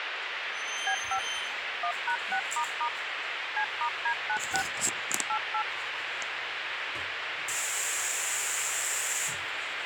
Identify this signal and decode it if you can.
DTMF, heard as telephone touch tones, dialled by machine, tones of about 80 ms, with radio hiss and the noise of a restroom. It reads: B5 1#6** C*D96 88